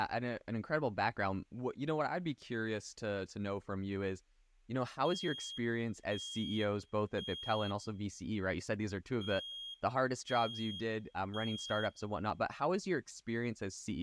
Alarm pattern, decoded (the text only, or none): temporal three